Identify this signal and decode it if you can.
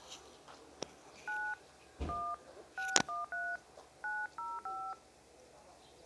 DTMF, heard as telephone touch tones, dialled by hand, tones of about 220 ms. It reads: 9 1 613 905